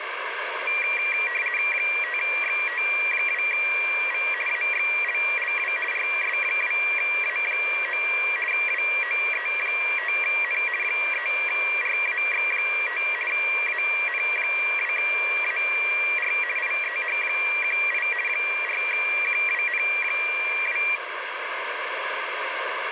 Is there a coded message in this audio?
Yes: RTTY (50 baud, 450 Hz shift) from 0.7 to 21.0 s, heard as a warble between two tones, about 2150 Hz centre, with radio static. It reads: 5XT2V AXLLW RS2A9 WOE5N 3RAX5 AN2AR IEH18 4QWN2